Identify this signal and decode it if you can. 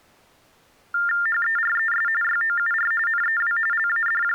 TTY/TDD text telephone tones (45.45 baud Baudot), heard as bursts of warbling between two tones, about 400 Hz shift, 1600 Hz centre. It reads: HERES YOUR NEW …